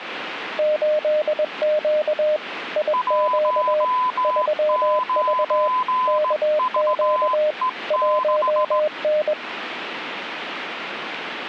Morse code, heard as two keyed tones, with radio static. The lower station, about 21 wpm, 610 Hz: 8Q IQ 3V KQ 1N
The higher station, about 17 wpm, 1010 Hz: 19VE6